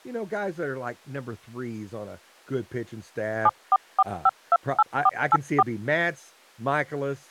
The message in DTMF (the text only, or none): 744528484